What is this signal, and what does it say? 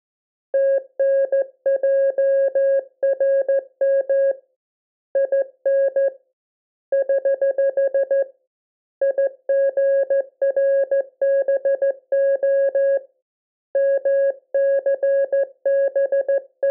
Morse code, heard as a keyed tone, hand-sent with a straight key, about 14 wpm, 550 Hz. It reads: TNJRM IN <HH> IGRBO …